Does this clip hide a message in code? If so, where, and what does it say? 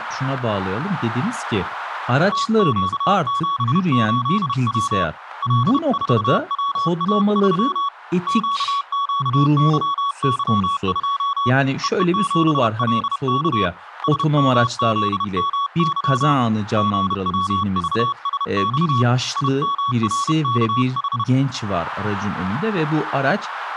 Yes: Morse code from 2.3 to 21.3 s, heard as a keyed tone, hand-sent with a paddle, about 31 wpm, 1120 Hz, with radio static and speech in Turkish. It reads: TQ78W L4WA3 QQYY2 EE7LK SMZMY GWVSX IMRKH